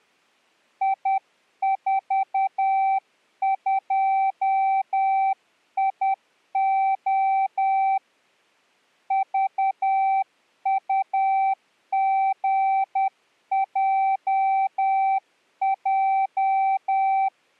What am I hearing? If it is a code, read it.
Morse code, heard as a keyed tone, hand-sent with a paddle, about 10 wpm, 780 Hz. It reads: I42IO VUGJJ